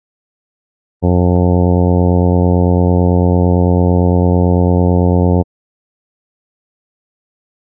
Ship horn signal, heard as a ship's horn, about 90 Hz. 1 long. At sea: a vessel nearing a blind bend, or under power and making way in fog.